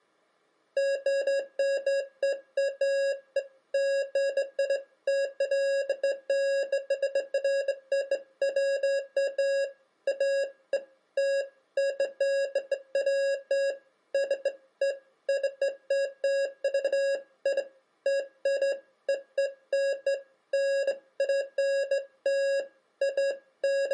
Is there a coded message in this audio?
No, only beeps of irregular length.